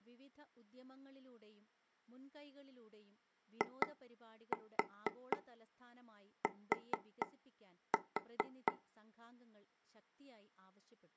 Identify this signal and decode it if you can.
Tap code, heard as taps on a table, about 4 knocks a second, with speech in Malayalam. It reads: IT